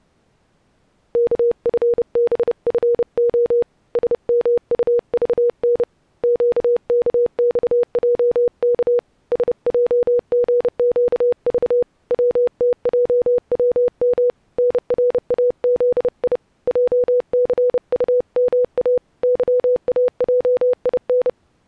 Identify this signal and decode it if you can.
Morse code, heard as a keyed tone, hand-sent with a paddle, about 30 wpm, 490 Hz. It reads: KFBFO SMUVN QKXJK SJGQV WTJWM NRAZI JCUMA YAJIN